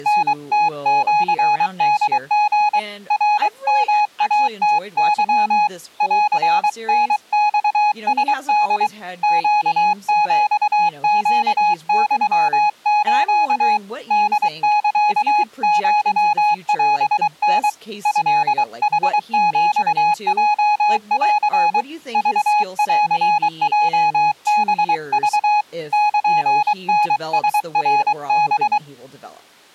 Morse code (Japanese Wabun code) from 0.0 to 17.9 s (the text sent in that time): タムシホリ ナヨイムケ ンタマラホ ネヒネユス ホサアオタ